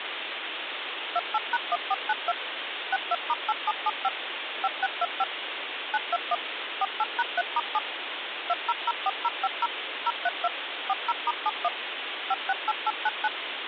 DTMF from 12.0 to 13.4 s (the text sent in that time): 568899